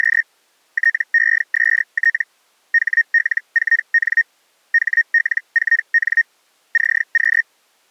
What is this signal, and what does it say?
Hellschreiber (Feld-Hell, 122.5 baud), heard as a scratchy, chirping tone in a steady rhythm, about 1850 Hz. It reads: … TEST HL4N HL4N CQ